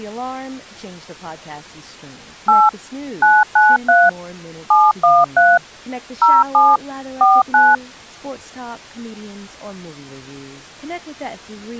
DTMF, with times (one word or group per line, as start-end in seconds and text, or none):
2.5-2.7 8
3.2-4.1 993
4.7-5.6 713
6.2-6.8 07
7.2-7.8 49